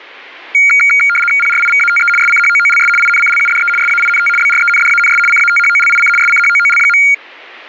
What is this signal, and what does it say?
RTTY (75 baud, 850 Hz shift), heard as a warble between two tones, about 1850 Hz centre. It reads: PRIVATE SCHOOLS INCLUDE SAINT BRENDANS CATHOLIC SCHOOL.